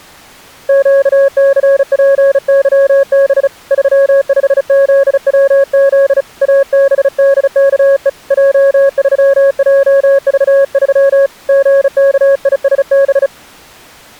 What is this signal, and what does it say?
Morse code, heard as a keyed tone, hand-sent with a bug key, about 35 wpm, 550 Hz. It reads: QCPYB 35ZWZ ABDKE J3JV3 GKISB